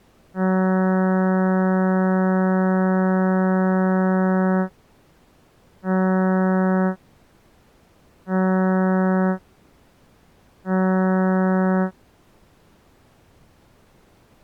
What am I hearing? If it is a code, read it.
Ship horn signal, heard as a ship's horn, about 190 Hz. 1 long, 3 short. At sea: a vessel under tow in fog.